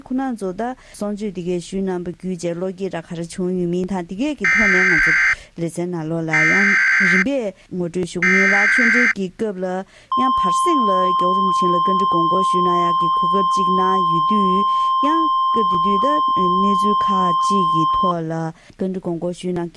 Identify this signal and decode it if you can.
Emergency Alert System (SAME) tones (header bursts, then the 1050 Hz attention tone), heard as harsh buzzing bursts, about 520.83 baud.